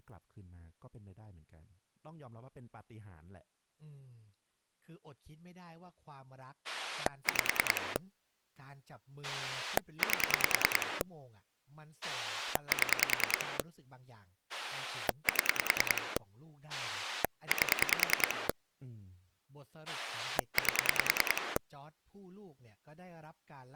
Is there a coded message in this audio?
Yes: pulse dialling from 6.6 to 21.6 s, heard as a rotary dial, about 10 pulses a second, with speech in Thai. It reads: 5 8 7 7 8 8